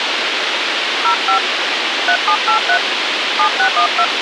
DTMF, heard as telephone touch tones, dialled by hand, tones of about 80 ms, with radio hiss. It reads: 05 3783 7612